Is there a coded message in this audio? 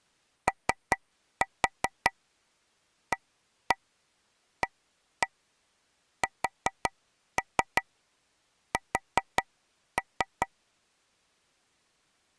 Yes: tap code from 0.5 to 10.5 s, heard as taps on a table, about 5 knocks a second. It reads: OAASS